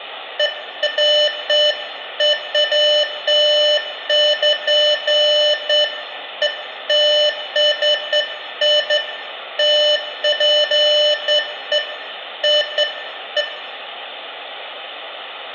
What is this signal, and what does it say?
Beeps of irregular length, with room echo. There is no code.